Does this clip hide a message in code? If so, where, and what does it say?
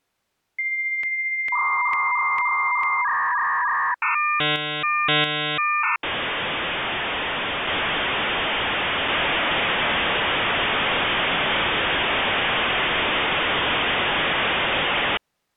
Yes: dial-up modem handshake (V.34 or later) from 0.6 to 15.2 s, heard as a whistle, warbles, then hiss.